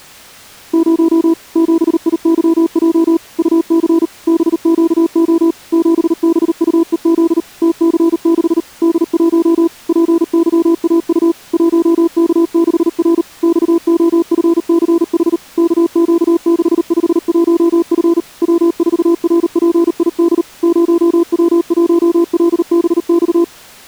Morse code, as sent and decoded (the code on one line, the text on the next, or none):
----- / --... .. -.-- .--- / ..- -.-. / -... --.- --- / --... -... ..- . --.. / - -.-. -.... / -.. .---- / .--. -.-- .- ..- / .---- -.- -.... .-. / -..- --- ..-. -.-. .... / -.- --.- -.... ..... .---- ..-. / .-- ....- .-. .--. .. -.. / ----- .-- .---- .-.. -... -..-
0 7IYJ UC BQO 7BUEZ TC6 D1 PYAU 1K6R XOFCH KQ651F W4RPID 0W1LBX